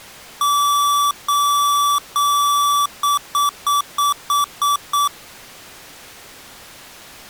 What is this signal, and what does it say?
Beep code, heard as beeps from a small speaker, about 1160 Hz. 3 long, 7 short.